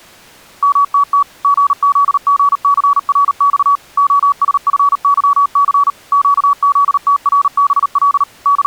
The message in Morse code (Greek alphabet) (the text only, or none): ΜΤΤ ΓΖΓΘΡΞ ΟΣΦΥΘ ΨΖΤΡΒΛ …